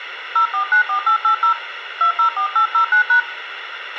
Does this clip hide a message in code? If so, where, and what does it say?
Yes: DTMF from 0.4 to 3.2 s, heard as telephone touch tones, dialled by hand, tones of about 100 ms, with radio hiss, a squelch burst at the end and room echo. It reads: 0494880 204809#